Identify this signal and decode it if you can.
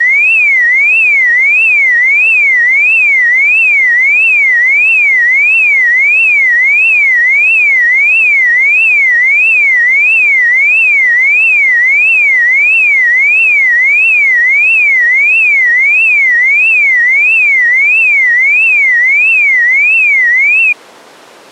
A tone that sweeps in pitch again and again. There is no code.